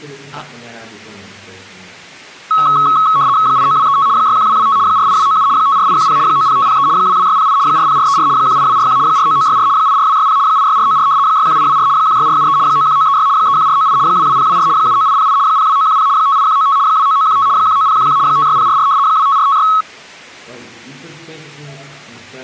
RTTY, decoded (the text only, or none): 89235 61225 48297 54810 90503 22608 40434 18241 49964 84260 86494 61824 16473 91936 31498 22024 79808 02910 58195 29915 19011 56044 25456